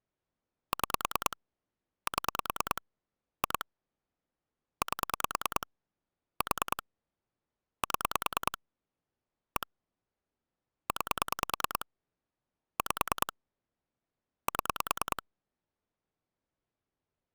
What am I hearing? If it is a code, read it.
Pulse dialling, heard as clicks on a phone line, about 9 pulses a second. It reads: 6 7 2 8 4 7 1 9 5 7